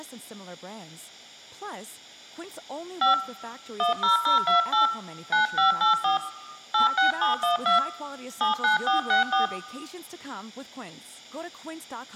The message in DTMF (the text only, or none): 5 10028 9584 86712 79464